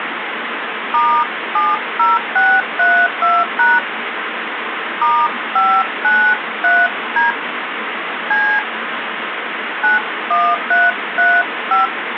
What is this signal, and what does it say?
DTMF, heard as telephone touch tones, dialled by hand, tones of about 220 ms, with phone line noise. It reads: *70632# *593D C 91335